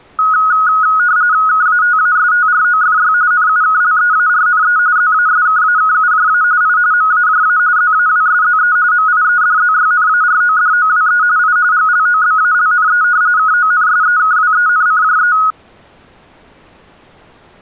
RTTY (45.45 baud, 170 Hz shift), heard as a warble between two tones, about 1360 Hz centre. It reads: KATASTROFY NUKLEARNE ZASKAKUJA I MAJA ZAWSZE MIEDZYNARODOWE I GLOBALNE KONSEKWENCJE